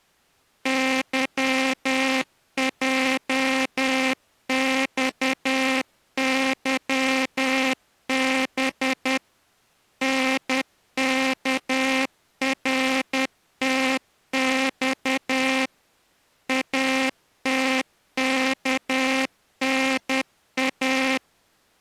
Morse code, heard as a buzzer, machine-sent, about 10 wpm. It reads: YJXYB NKRTX ATKNA